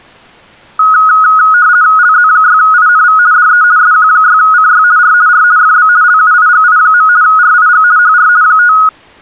RTTY (50 baud, 170 Hz shift), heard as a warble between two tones, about 1360 Hz centre. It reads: LZ6INV DE SQ6CY R R FB LUIGI. RIG HR 5